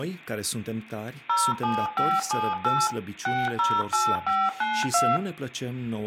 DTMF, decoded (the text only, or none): 07578 608592